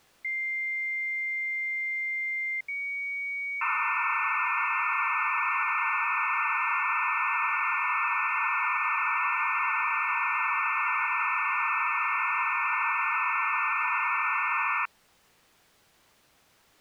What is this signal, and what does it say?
Dial-up modem handshake (low-speed, two carriers), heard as two whistles, then hiss.